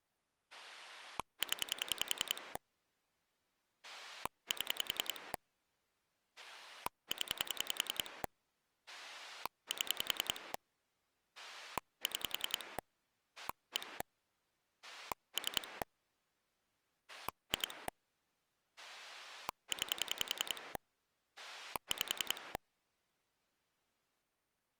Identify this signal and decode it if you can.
Pulse dialling, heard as a rotary dial, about 10 pulses a second. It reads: 0 7 0 7 6 1 3 2 9 5